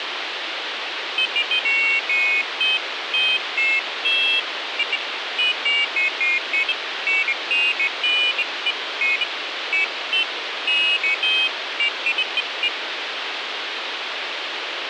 Pairs of high tones at irregular times, with radio hiss. There is no code.